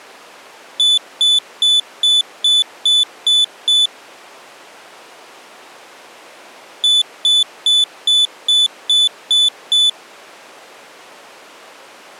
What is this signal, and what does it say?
Beep code, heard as a piezo beeper, played twice, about 3500 Hz. 8 short. In AMI BIOS tables: display memory failure; in Dell tables: LCD failure.